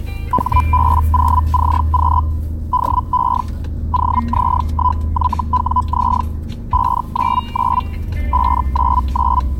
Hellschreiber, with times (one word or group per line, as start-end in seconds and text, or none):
0.3-2.2 HB0CQ
2.7-3.4 DE
3.9-6.2 OZ1YWZ
6.7-7.8 599
8.3-9.4 599